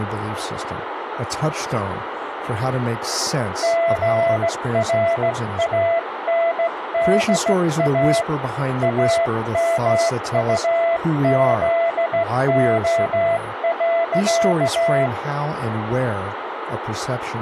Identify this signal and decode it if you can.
Morse code, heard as a keyed tone, hand-sent with a straight key, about 16 wpm, 670 Hz, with radio static, a narrow filter and speech in English. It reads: GRANDA AMUZO.